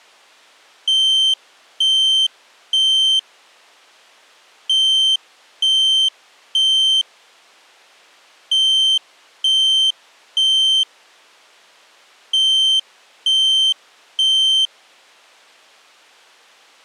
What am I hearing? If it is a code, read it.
Alarm pattern, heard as an alarm's beeps, played four times, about 3100 Hz. Temporal three. Smoke or fire, evacuate.